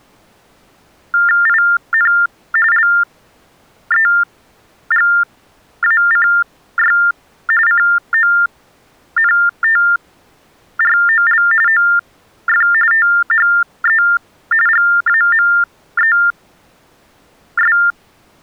TTY/TDD text telephone tones (45.45 baud Baudot), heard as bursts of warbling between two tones, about 400 Hz shift, 1600 Hz centre. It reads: IN LEGACY CONTROL OF THE GAMES